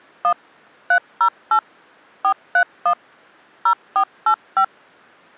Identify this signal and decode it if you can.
DTMF, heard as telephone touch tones, dialled by machine, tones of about 80 ms. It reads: 1 308 431 0485